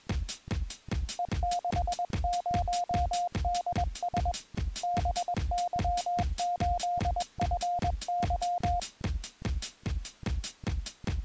Morse code, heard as a keyed tone, hand-sent with a paddle, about 21 wpm, 710 Hz. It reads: E60DS BY8FY